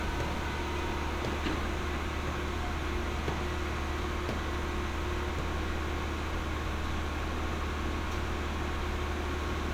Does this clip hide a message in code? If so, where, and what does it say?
No, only street noise.